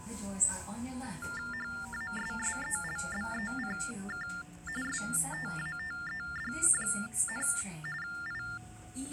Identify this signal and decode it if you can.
TTY/TDD text telephone tones (45.45 baud Baudot), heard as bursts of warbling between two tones, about 400 Hz shift, 1600 Hz centre, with the noise inside a subway train. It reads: HASSELBECK STATED, I